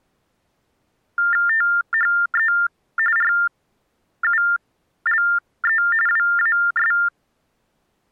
TTY/TDD text telephone tones (45.45 baud Baudot), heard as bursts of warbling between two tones, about 400 Hz shift, 1600 Hz centre. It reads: THE RULE WAS